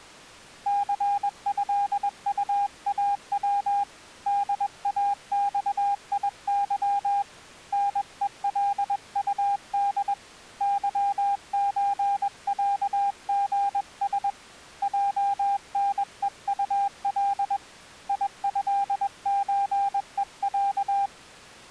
Morse code (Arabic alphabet), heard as a keyed tone, hand-sent with a paddle, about 21 wpm, 800 Hz. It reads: ثهطاو داصيظ نءلطد ظزعغس جنءطل يهزءع